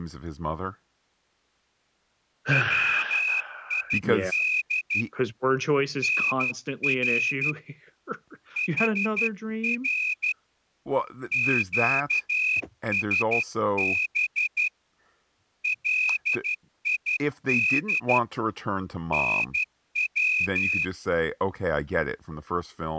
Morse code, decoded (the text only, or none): WID NR HR QSB LID NW